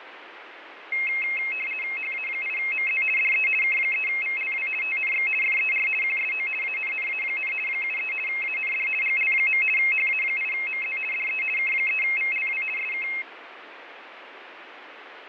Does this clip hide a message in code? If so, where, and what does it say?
Yes: RTTY (50 baud, 450 Hz shift) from 0.9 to 13.2 s, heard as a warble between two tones, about 2350 Hz centre, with radio static and fading. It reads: HA8MZ DE K3VLW TNX FER QSO ANNA, 73 AND GL. HA8MZ DE K3VLW SK